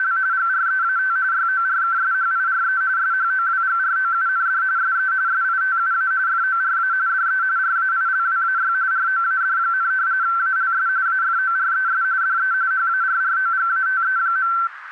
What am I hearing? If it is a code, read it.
RTTY (45.45 baud, 170 Hz shift), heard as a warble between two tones, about 1440 Hz centre, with radio static. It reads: … GREAT YORKSHIRE SHOWGROUND SE SITUA FORA DE RAILWAY ROAD, ALS AFORES DE HARROGATE.